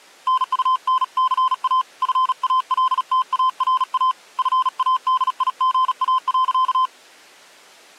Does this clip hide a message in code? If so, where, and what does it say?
Yes: Morse code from 0.2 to 6.9 s, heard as a keyed tone, hand-sent with a paddle, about 37 wpm, 1030 Hz. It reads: NUNCA FALTARA FADIGA.